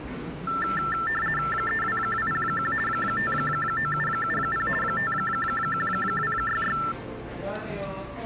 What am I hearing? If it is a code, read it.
RTTY (50 baud, 450 Hz shift), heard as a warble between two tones, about 1550 Hz centre, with the noise of a cafe. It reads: 32201 59770 51266